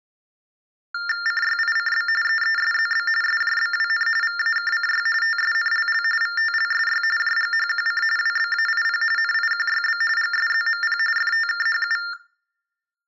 TTY/TDD text telephone tones (45.45 baud Baudot), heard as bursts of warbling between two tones, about 400 Hz shift, 1600 Hz centre, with room echo. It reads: CYICB EESZB SJBWN VAKCY TSNLL VTLSY JGHQC WBAIP NIQYB GSZMP FTKHU